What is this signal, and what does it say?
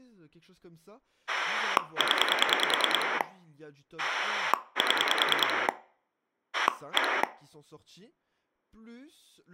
Pulse dialling, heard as a rotary dial, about 10 pulses a second, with speech in French. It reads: 0 7 1